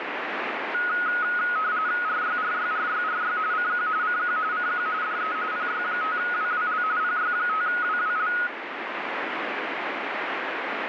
RTTY (45.45 baud, 170 Hz shift), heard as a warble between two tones, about 1360 Hz centre, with radio static. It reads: RYRYRYRY CQ CQ CQ DE PY5WWL PY5WWL